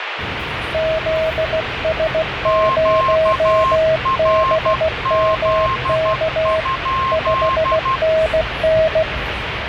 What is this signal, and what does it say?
Morse code, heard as two keyed tones, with radio static and the noise inside a subway train. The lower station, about 16 wpm, 640 Hz: ZS0BMK 5NN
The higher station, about 12 wpm, 1060 Hz: QRZ?